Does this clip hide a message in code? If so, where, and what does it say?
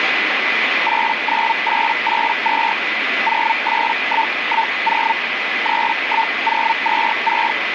Yes: Hellschreiber (Feld-Hell, 122.5 baud) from 0.9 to 7.5 s, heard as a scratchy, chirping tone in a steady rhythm, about 900 Hz, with radio static and a steady whistle near 2010 Hz. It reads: 89882 08110 31026